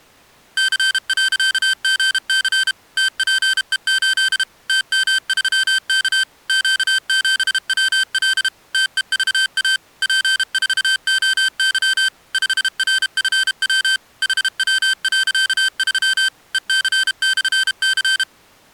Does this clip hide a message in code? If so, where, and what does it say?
Yes: Morse code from 0.5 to 18.3 s, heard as electronic beeps, machine-sent, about 32 wpm, 1550 Hz. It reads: C.GC TPE8 TM3K Q7WL TEVA P4OY 5RFW HW.3 EC/C